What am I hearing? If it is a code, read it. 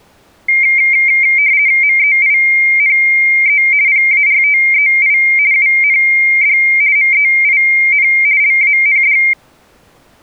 RTTY (50 baud, 170 Hz shift), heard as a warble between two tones, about 2200 Hz centre. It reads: MEINE PARTEI UND MEIN LAND